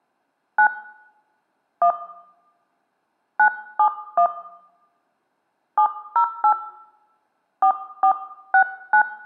DTMF, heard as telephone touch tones, dialled by hand, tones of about 90 ms, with room echo. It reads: 9 1 971 708 4469